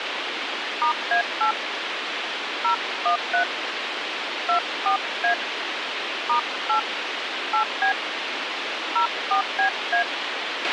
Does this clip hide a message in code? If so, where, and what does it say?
Yes: DTMF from 0.8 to 10.0 s, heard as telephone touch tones, dialled by hand, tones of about 100 ms, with radio hiss and a squelch burst at the end. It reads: *A8 013 24A *8 8B 04BA